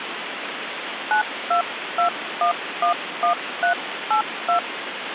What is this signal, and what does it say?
DTMF, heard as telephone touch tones, dialled by hand, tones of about 110 ms, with phone line noise. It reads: 922111382